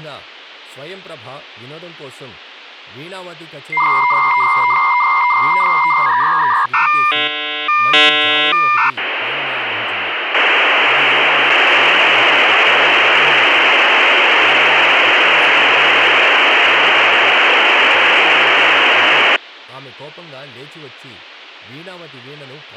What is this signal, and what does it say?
Dial-up modem handshake (V.34 or later), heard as a whistle, warbles, then hiss, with speech in Telugu.